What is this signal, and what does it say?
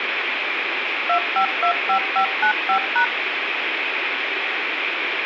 DTMF, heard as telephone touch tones, dialled by machine, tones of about 90 ms, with radio hiss. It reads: 2525595#